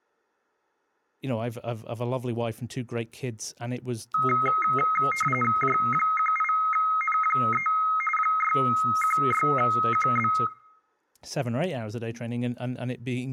RTTY (45.45 baud, 850 Hz shift), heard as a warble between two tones, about 1700 Hz centre, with room echo and speech in English. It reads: J18N3 616QB